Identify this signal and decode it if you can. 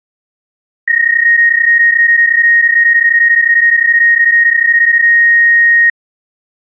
PSK31 (31.25 baud), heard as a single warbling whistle, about 1850 Hz.